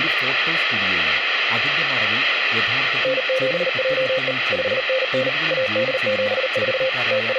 Morse code, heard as a keyed tone, machine-sent, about 39 wpm, 520 Hz, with radio static and speech in Malayalam. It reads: N7JE 5NN AD74 …